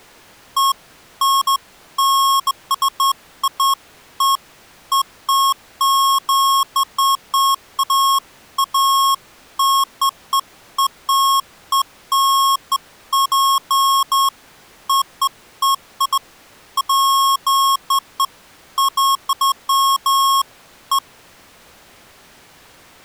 Beeps of irregular length. There is no code.